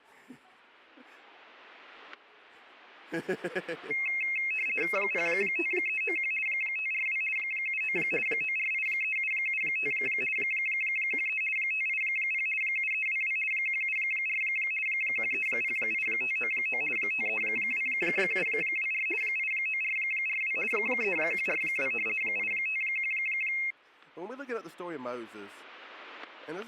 RTTY (50 baud, 450 Hz shift), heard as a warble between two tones, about 2350 Hz centre, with static crashes. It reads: 05391 542 79 9483775 13 580 7322 174 1308599 532724 89442 3142 851